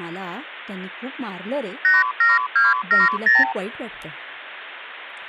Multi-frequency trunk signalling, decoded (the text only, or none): 87270